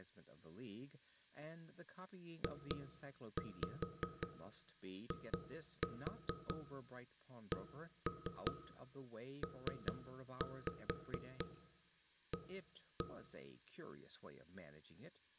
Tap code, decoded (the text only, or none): JICPA